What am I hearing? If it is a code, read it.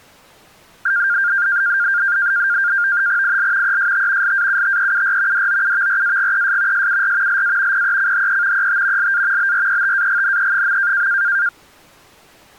NAVTEX (SITOR-B), 100 baud, 170 Hz shift, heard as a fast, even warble, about 1500 Hz centre. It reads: IL EST LAUTEUR DOUVRAGES SUR LA PECHE ET LA BRETAGNE.